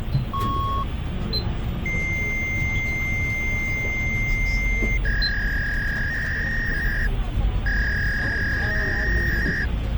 Fax machine handshake, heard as a beep, a long tone and a warble, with phone line noise and the noise inside a bus.